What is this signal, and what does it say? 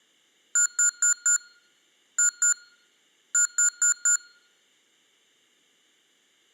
Beep code, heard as beeps from a small speaker, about 1430 Hz. 4-2-4. In Phoenix BIOS tables: unexpected interrupt in protected mode.